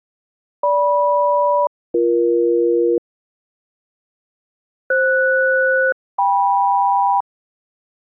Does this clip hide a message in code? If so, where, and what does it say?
Yes: aircraft SELCAL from 0.6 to 7.2 s, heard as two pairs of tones. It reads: GM-BE FS-KM